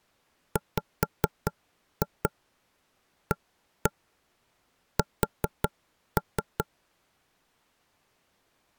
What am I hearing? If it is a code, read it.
Tap code, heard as knocks on wood, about 4 knocks a second. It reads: WAS